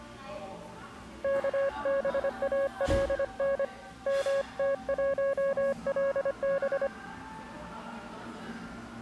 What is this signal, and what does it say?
Morse code, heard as a keyed tone, hand-sent with a paddle, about 25 wpm, 550 Hz, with the noise of a cafe. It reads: KBALN MT1LB